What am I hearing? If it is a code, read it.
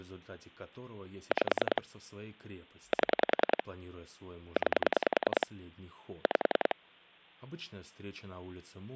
Pulse dialling, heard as clicks on a phone line, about 10 pulses a second, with speech in Russian. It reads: 5 7 9 5